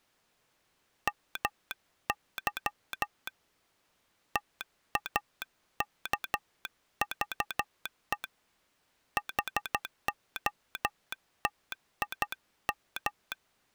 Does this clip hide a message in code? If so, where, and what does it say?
Yes: Morse code (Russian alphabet) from 1.0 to 13.4 s, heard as a telegraph sounder, hand-sent with a straight key, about 12 wpm. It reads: МЫ ТАКЖЕ ХОТИМ